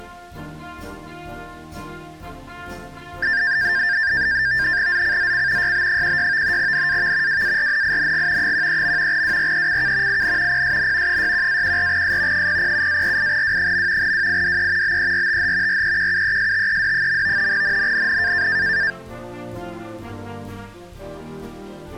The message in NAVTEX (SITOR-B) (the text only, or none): ZCZC YB16 NAV WARNING 13. WRECK IN PSN 61-14S 007-48W. WIDE BERTH REQUESTED. NNNN